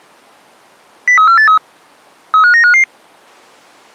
Five-tone selective call (CCIR), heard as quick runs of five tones, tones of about 100 ms. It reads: 03483 35955